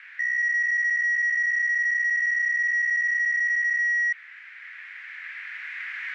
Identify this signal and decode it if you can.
PSK63 (62.5 baud), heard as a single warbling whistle, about 1900 Hz, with radio static.